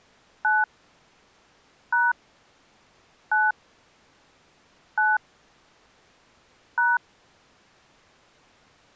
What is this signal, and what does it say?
DTMF, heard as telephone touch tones, dialled by hand, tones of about 190 ms. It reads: 9 # 9 9 #